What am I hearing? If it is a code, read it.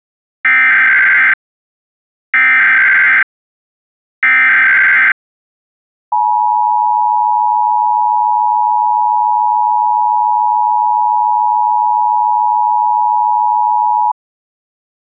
Emergency Alert System (SAME) tones (header bursts, then the 853 and 960 Hz attention tone), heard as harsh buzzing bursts, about 520.83 baud.